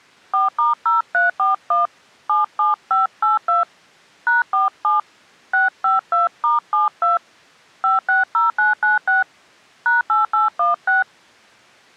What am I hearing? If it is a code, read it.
DTMF, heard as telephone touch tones, dialled by hand, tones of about 150 ms. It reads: 4*0341 77582 #47 652*72 560996 #8816